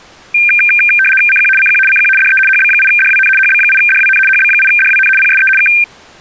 RTTY (75 baud, 850 Hz shift), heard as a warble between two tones, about 2000 Hz centre. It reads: CQ CQ CQ DE HB8DWN HB8DWN HB8DWN PSE K